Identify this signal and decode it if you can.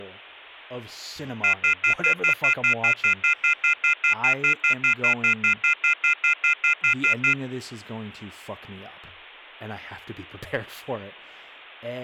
Telephone call progress tone (North American plan), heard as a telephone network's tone, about 1400, 2050, 2450, 2600 Hz, 0.1 s on and 0.1 s off, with speech in English. Off-hook warning tone.